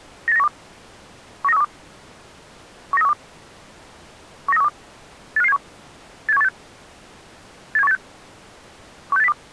Five-tone selective call (EEA), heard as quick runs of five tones, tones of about 40 ms. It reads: 98912 19312 19312 19312 85571 87186 87186 16802